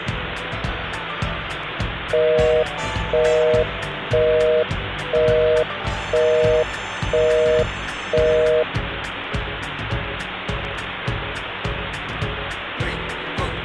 Telephone call progress tone (North American plan), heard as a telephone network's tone, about 480, 620 Hz, 0.5 s on and 0.5 s off, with phone line noise. Busy tone.